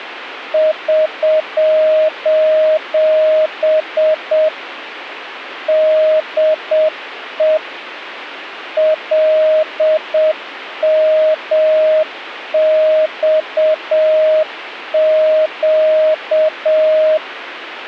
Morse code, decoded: <SOS> DE LMXQ

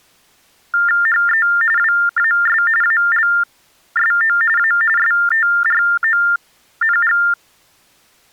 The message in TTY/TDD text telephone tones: HE WAS ALSO A STRONG

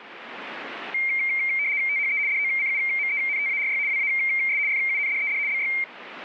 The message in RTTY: THE DOCUMENTARY WAS FUNDED BY

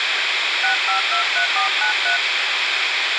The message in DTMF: 6523493

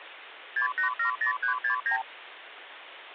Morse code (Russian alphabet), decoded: none

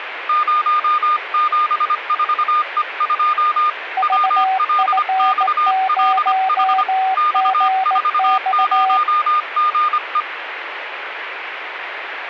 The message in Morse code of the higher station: 074E2 WLXLH X40GE

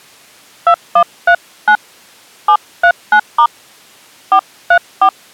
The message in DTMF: 2139 739* 434

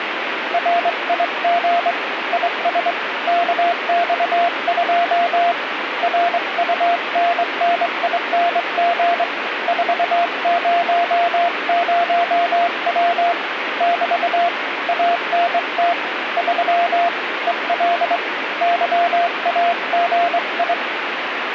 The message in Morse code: RIG IS KX2 RUNNING 400W <BT> ANT 3 EL YAGI

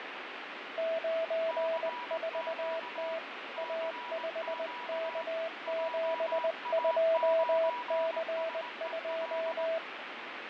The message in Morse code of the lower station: 94T A5K72C2

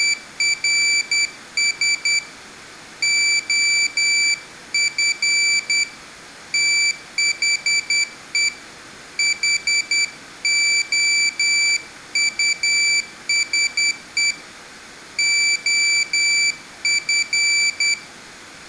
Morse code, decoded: … OF THE HOUSE OF

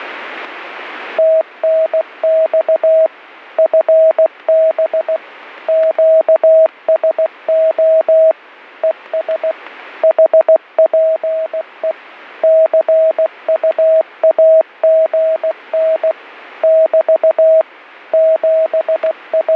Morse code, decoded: TNX FB QSO ES HPE CUAGN <BT> …

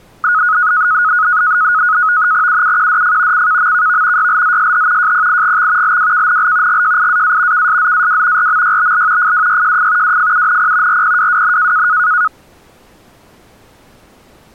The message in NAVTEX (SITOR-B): UUQDF CKMKV YLZSH JPIGX LWKNL GJIAA KSZAW RMYBL FWYJF WFUNP RPWWN

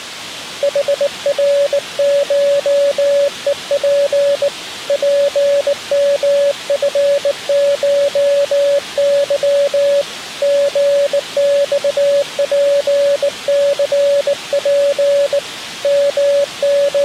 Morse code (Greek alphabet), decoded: ΗΡΧΕΠ ΠΜΦΧΥ ΓΞΠΘΠ …

